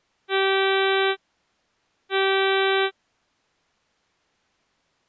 Ship horn signal, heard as a ship's horn, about 390 Hz. 2 short. At sea: I am altering course to port.